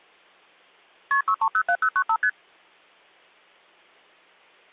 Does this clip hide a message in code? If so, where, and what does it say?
Yes: multi-frequency trunk signalling (R1, as on North American trunks) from 1.1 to 2.3 s, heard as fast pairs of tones, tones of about 70 ms. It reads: KP 6307095 ST